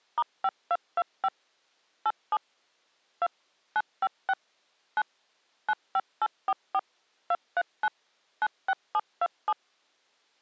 DTMF, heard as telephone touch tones, dialled by machine, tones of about 50 ms. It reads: *5225 87 2 956 9 95844 239 96727